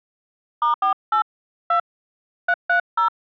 DTMF, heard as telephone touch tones, dialled by hand, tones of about 100 ms. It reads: *48 2 330